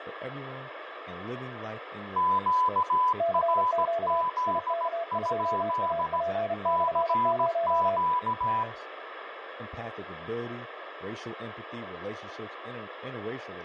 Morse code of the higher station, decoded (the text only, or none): QRZ? CQ